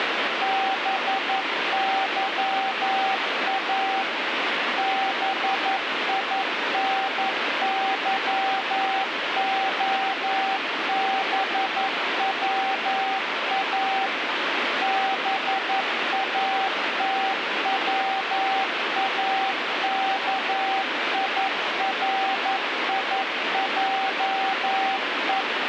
Morse code, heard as a keyed tone, machine-sent, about 11 wpm, 770 Hz, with radio static. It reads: BYA BINYOBWA BATWAKIRIJE